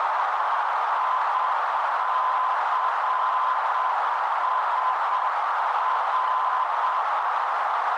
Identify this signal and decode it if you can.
Morse code, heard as a keyed tone, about 7 wpm, 1020 Hz, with heavy radio static and a narrow filter. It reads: ICSR